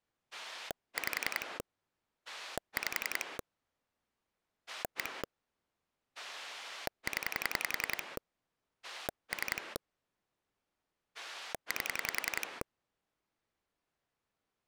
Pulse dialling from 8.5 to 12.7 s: 3 8

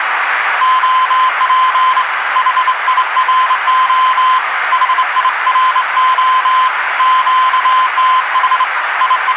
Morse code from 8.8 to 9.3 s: …

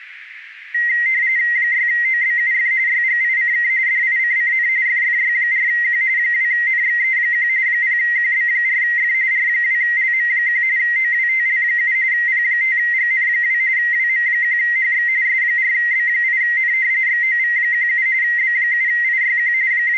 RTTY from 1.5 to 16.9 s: 6OBUF YGICK DICCN FFY4Q 2NXE1 0QB4F R2LM1 OWTL7 P5GN2 WM1HX S4B8N

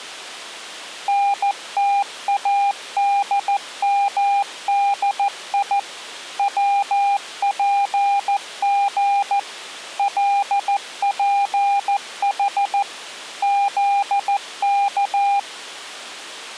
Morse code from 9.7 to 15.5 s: LPH ZK

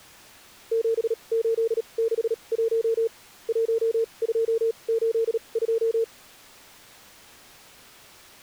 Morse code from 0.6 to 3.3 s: 7861

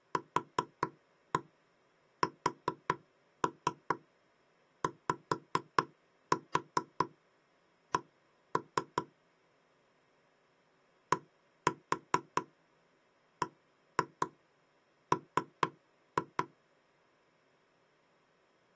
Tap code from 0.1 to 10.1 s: QSYC

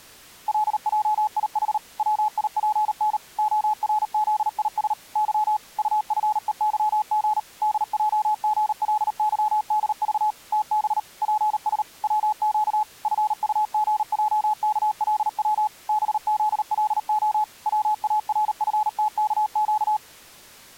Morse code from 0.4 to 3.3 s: LJIH WIPN

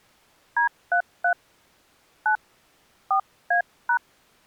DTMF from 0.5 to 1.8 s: D33

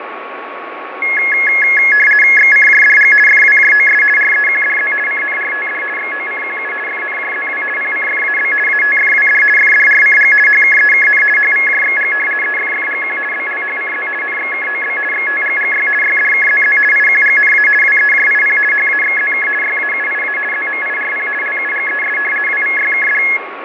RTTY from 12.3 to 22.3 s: EFFGQ BLHCZ NXKOB XTGGY YDKZZ IQGNA WEJIP HAXZK YAUIA ZMIRP LUGES

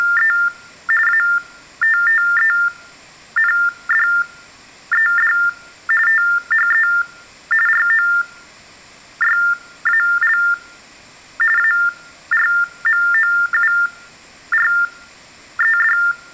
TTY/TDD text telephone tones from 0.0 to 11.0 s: … ATTENDED THE ROYAL

